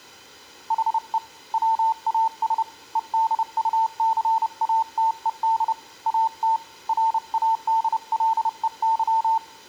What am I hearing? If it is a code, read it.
Morse code, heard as a keyed tone, hand-sent with a paddle, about 30 wpm, 900 Hz. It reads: HE WAS EDUCATED AT RADLEY